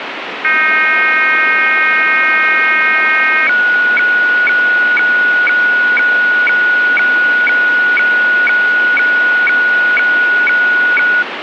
Weather fax (radiofax), 120 lines a minute, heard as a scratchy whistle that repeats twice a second, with radio static.